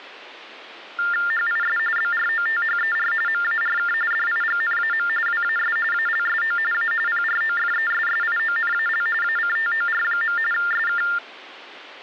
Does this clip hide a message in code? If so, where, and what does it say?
Yes: TTY/TDD text telephone tones (45.45 baud Baudot) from 1.0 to 11.2 s, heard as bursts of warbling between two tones, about 400 Hz shift, 1600 Hz centre. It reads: HIS BROTHER MARK DIGNAM WAS ALSO A PROFESSIONAL ACTOR. SK